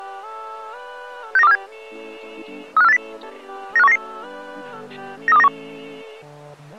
Five-tone selective call (EEA), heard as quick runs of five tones, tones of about 40 ms. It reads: 69247 35480 95199 93291